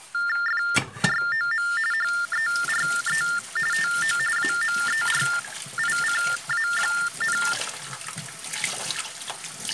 TTY/TDD text telephone tones (45.45 baud Baudot), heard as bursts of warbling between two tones, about 400 Hz shift, 1600 Hz centre, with kitchen noise. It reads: FROM HERE TO AMERICA,